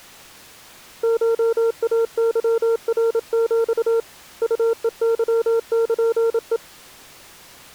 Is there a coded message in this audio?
Yes: Morse code (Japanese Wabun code) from 1.0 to 6.6 s, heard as a keyed tone, hand-sent with a paddle, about 27 wpm, 460 Hz. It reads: コイケナヒ ウヘケルヘ